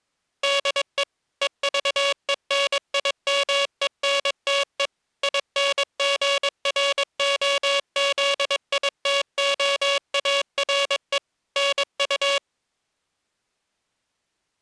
Morse code, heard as a buzzer, machine-sent, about 22 wpm. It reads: DE EVENIMENTE INGROZITOARE NU